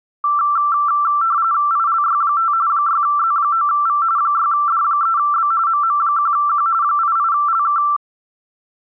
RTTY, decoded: ILY5 6Z9V 6D3B MM1Q 88LK

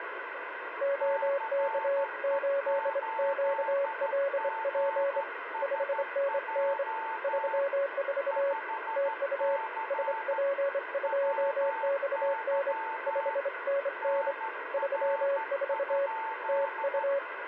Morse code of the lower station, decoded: OK8QLP 5NN 34 TU SP2XN 5NN 34 TU

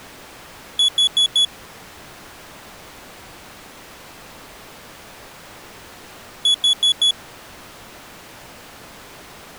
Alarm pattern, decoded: temporal four

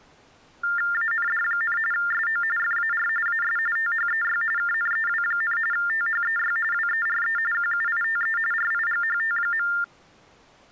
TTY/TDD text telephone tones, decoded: AND, SO FAR AS THEY KNEW, THEY WERE QUITE RIGHT.

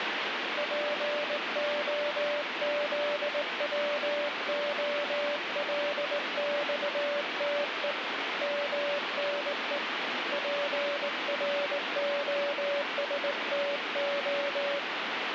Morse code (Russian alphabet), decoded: ПОЗВОЛЬТЕ МНЕ ПРОСТО

